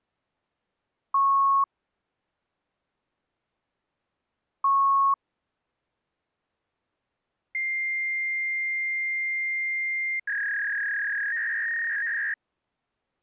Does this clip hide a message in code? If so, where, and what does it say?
Yes: fax machine handshake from 1.1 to 12.3 s, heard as beeps, a long tone and a warble.